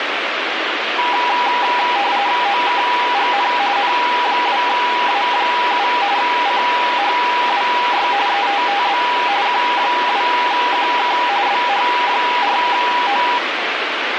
RTTY (45.45 baud, 170 Hz shift), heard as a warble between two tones, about 890 Hz centre, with radio static. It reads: OKGN N2A7 CHWY ETTB Q2QK BH4O